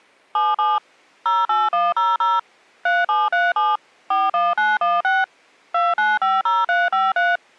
DTMF, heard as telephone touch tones, dialled by machine, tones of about 200 ms. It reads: 77 08100 3737 41916 2950353